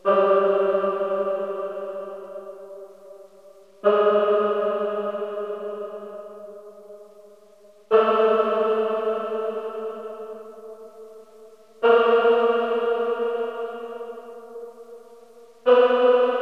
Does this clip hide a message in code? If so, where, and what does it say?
No.